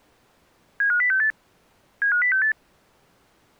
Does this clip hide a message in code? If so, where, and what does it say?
Yes: five-tone selective call (CCIR) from 0.8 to 2.5 s, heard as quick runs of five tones, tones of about 100 ms. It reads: 75068 75068